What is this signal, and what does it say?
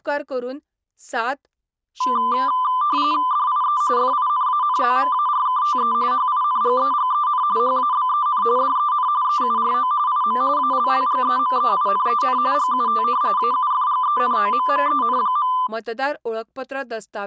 RTTY (45.45 baud, 170 Hz shift), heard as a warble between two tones, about 1100 Hz centre, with speech in Goan Konkani. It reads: DIE FINANZMARKTE HINGEGEN HABEN DEN EURO IM ALLGEMEINEN GUT AUFGENOMMEN.